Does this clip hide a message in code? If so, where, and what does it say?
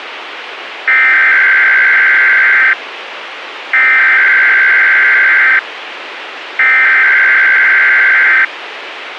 Yes: Emergency Alert System (SAME) tones (header bursts) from 0.9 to 8.4 s, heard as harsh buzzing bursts, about 520.83 baud, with radio hiss.